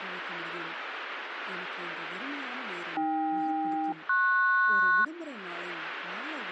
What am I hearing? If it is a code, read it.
Aircraft SELCAL, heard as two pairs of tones, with radio static and speech in Tamil. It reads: AK-PS